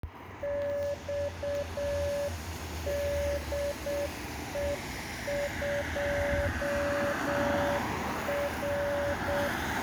Morse code, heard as a keyed tone, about 7 wpm, 570 Hz, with room echo and street noise. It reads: XDE2R